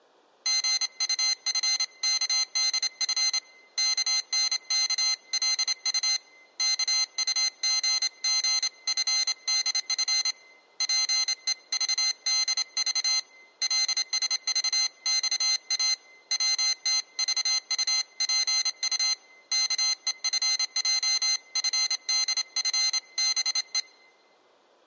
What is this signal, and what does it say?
Morse code (Korean alphabet), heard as a high beeper, hand-sent with a straight key, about 27 wpm, 2050 Hz, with room echo. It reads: 신은 용기 있는 자를 결코 버리지 않는다